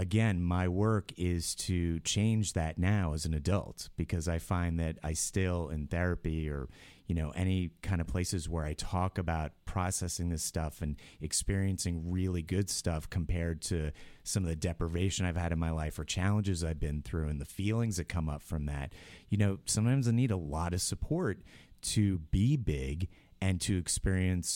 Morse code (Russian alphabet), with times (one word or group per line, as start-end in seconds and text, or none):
none